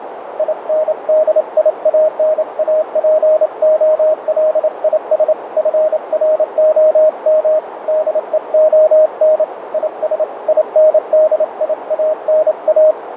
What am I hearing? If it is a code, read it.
Morse code, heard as a keyed tone, hand-sent with a paddle, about 28 wpm, 620 Hz, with radio static and a narrow filter. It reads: INDIANAPOLIS FROM DEON IS INDIANA